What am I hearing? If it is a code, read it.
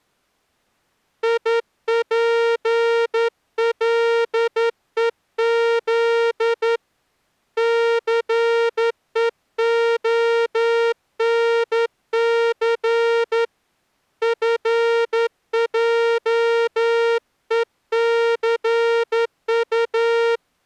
Morse code, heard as a horn, hand-sent with a straight key, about 11 wpm. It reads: IPLEZ CEONC FJECU